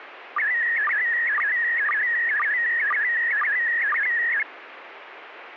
SSTV (slow-scan television), PD 120, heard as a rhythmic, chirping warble, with radio static.